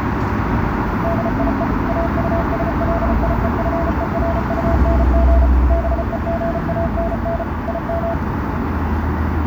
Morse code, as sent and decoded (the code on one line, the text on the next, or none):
-.. .. . / .- ..- ... .-.. .. . ..-. . .-. ..- -. --. / -... . --. .- -. -. / .. --
DIE AUSLIEFERUNG BEGANN IM